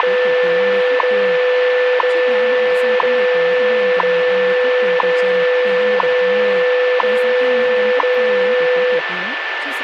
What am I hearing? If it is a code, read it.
Radio time signal (WWV, Colorado), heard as ticks, one a second, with radio static, a steady whistle near 1760 Hz and speech in Vietnamese.